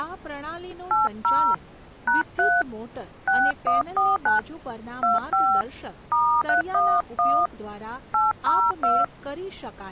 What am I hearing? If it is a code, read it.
DTMF, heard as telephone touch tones, dialled by hand, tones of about 210 ms, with speech in Gujarati. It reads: 80 #3 6149 25 *311 802